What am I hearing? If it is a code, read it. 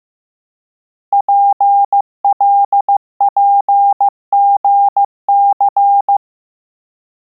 Morse code, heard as a keyed tone, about 15 wpm, 800 Hz. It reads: PLPGC